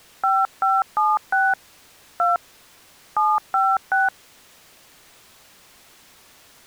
DTMF, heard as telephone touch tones, dialled by hand, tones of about 200 ms. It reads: 5576 2 756